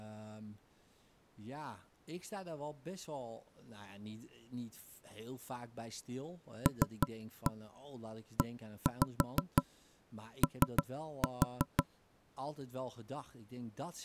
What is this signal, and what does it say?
Tap code, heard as knocks on wood, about 5 knocks a second, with speech in Dutch. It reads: LEO